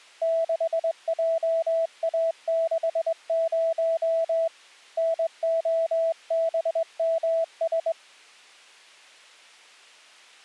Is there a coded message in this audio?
Yes: Morse code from 0.2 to 8.0 s, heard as a keyed tone, hand-sent with a straight key, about 22 wpm, 660 Hz. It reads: 6JA60 NOBMS